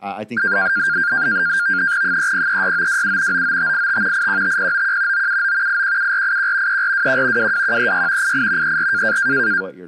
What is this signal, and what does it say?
NAVTEX (SITOR-B), 100 baud, 170 Hz shift, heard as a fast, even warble, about 1500 Hz centre, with speech in English. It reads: 3036927 99585 815091 979 817481 3421 22136 88 34